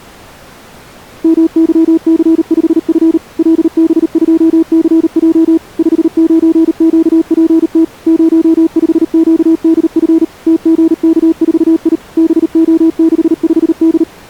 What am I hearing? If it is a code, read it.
Morse code, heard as a keyed tone, machine-sent, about 38 wpm, 320 Hz. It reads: MYC5F LB2CJ 59QPT 05QDF TGK4I BO65D